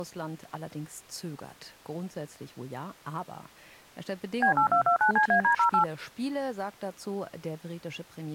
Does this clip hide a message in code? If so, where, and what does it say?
Yes: DTMF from 4.4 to 5.8 s, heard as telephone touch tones, dialled by machine, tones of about 100 ms. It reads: B8229CAD08